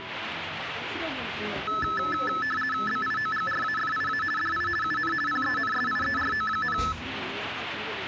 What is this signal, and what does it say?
RTTY (50 baud, 450 Hz shift), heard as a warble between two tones, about 1500 Hz centre, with radio static and the noise of a cafe. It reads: BIOGRAFIA DI UN PENSIERO,